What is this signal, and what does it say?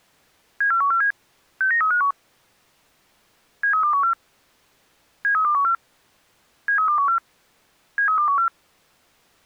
Five-tone selective call (CCIR), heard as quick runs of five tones, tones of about 100 ms. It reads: 74147 69351 73214 73214 73214 73214